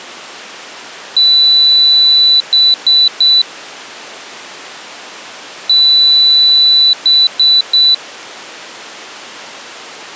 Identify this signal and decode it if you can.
Beep code, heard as a piezo beeper, played twice, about 3950 Hz. 1 long, 3 short. In Award and IBM BIOS tables: video adapter failure; in AMI BIOS tables: memory failure.